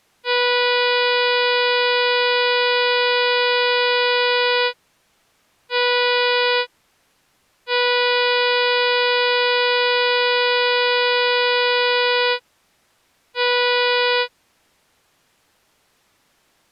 Ship horn signal, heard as a ship's horn, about 490 Hz. 1 long, 1 short, 1 long, 1 short. At sea: I agree to be overtaken.